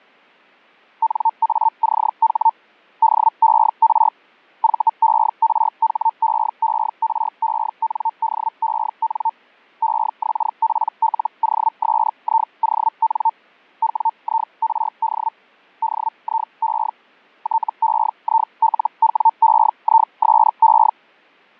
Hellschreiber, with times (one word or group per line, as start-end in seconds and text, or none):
1.0-2.5 NACH
3.0-4.1 DER
4.6-9.3 VERHEERENDEN
9.8-13.3 EXPLOSION
13.8-15.3 WIRD
15.8-16.9 DIE
17.4-20.9 TEILWEISE